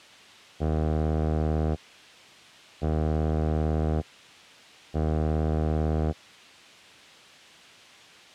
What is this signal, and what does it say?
Ship horn signal, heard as a ship's horn, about 80 Hz. 3 short. At sea: I am operating astern propulsion.